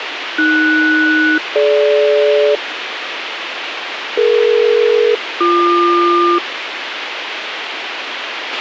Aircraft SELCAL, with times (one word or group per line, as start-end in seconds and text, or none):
0.4-2.6 AS-DG
4.2-6.4 DE-BQ